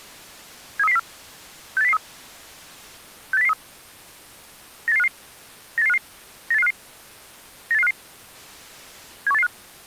Five-tone selective call (EEA), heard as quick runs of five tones, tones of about 40 ms. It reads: 73304 68003 68003 98855 98855 98855 98855 71885